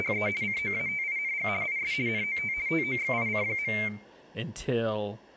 RTTY (50 baud, 170 Hz shift), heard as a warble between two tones, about 2200 Hz centre, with speech in English. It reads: … COATING IS NOT TOXIC.